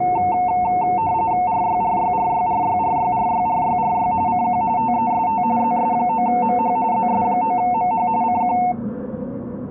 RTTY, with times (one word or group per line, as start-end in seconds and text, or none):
1.5-4.1 RYRYRYRYRYRYRYRY
4.3-4.6 CQ
4.8-5.4 TEST
5.6-6.8 ZS9MH
6.9-8.1 ZS9MH
8.2-8.6 CQ